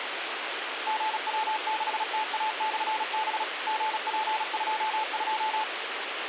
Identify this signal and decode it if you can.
Morse code, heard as a keyed tone, machine-sent, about 36 wpm, 870 Hz, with radio hiss. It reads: GW6TA/B GP22